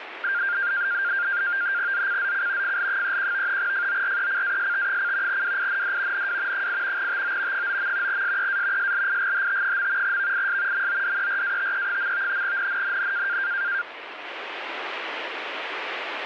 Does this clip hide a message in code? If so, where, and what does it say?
Yes: NAVTEX (SITOR-B), 100 baud, 170 Hz shift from 0.2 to 13.8 s, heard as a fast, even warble, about 1500 Hz centre, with radio static. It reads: ZCZC FL31 FORECAST: WIND NW 8 TO 9. SEA SLIGHT. VIS MODERATE. NNNN